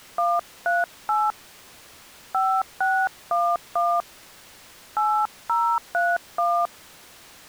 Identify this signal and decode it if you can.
DTMF, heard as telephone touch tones, dialled by hand, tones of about 230 ms. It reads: 138 5611 8031